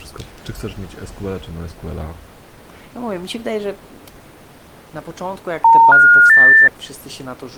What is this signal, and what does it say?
Telephone call progress tone (North American plan), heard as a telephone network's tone, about 910, 1430, 1800 Hz, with speech in Polish. Special information tone.